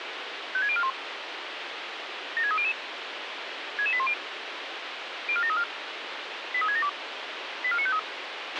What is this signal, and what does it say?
Five-tone selective call (ZVEI), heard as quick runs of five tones, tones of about 70 ms, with radio hiss and a squelch burst at the end. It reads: 56041 76300 66810 04734 83672 84953